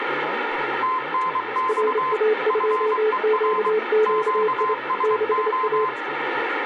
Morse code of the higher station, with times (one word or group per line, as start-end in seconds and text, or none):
0.8-2.1 TNX
2.5-3.7 FER
4.1-5.9 QSO